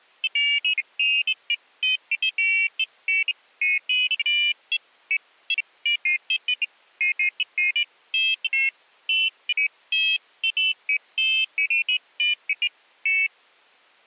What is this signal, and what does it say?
Pairs of high tones at irregular times. There is no code.